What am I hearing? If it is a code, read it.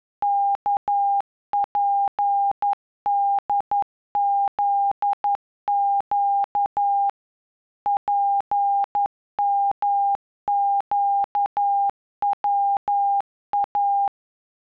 Morse code, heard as a keyed tone, machine-sent, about 11 wpm, 800 Hz. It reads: KPDZQ PMQWA